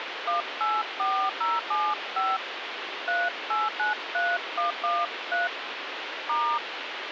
DTMF, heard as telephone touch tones, dialled by hand, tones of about 230 ms, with phone line noise. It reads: 184075 3893113 *